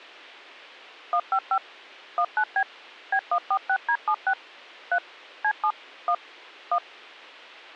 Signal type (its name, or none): DTMF